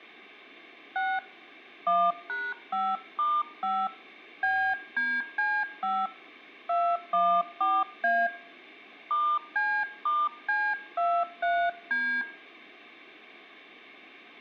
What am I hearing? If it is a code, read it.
DTMF, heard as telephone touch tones, dialled by hand, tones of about 260 ms. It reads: 6 1#5*5 BDC5 214A *C*C23D